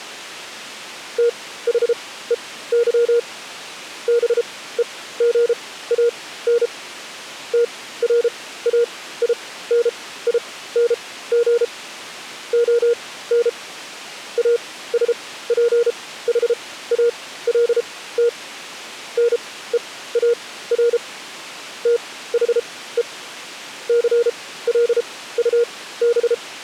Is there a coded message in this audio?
Yes: Morse code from 1.1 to 26.4 s, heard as a keyed tone, machine-sent, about 33 wpm, spaced as for 17 wpm, 470 Hz. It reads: THEY BEGAN TRAINING ON ASPHALT NEAR THE CLUB